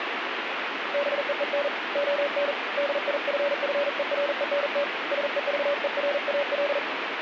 Morse code, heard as a keyed tone, hand-sent with a paddle, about 40 wpm, 570 Hz, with radio static. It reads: BEEN ON DIFFERENT SEVERAL